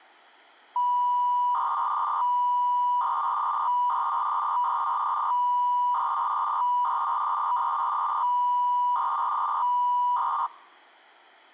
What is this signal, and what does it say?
300-baud modem data (V.21 tones), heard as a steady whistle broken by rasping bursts, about 300 baud, 200 Hz shift.